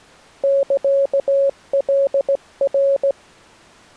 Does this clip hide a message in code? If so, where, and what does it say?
Yes: Morse code (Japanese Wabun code) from 0.4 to 3.2 s, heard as a keyed tone, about 16 wpm, 550 Hz. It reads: サカナ